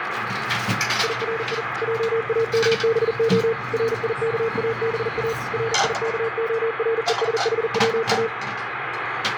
Morse code, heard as a keyed tone, machine-sent, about 40 wpm, 460 Hz, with radio static and the noise of a restaurant. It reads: IRI JAMBO RIKABA RIKORESHWA